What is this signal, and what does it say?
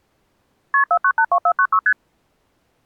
Multi-frequency trunk signalling (R1, as on North American trunks), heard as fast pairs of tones, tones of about 70 ms. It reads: KP 4982496 ST